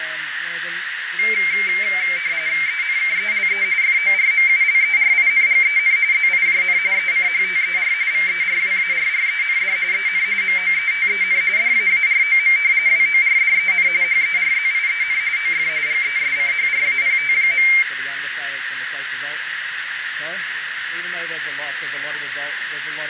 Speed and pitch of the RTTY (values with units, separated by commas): 45.45 baud, 170 Hz shift, 2200 Hz centre